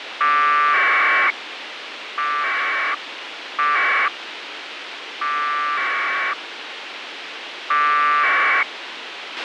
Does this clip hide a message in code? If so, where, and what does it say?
Yes: packet radio (AX.25, as in APRS), 1200 baud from 0.2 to 8.6 s, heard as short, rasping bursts, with radio hiss and a squelch burst at the end.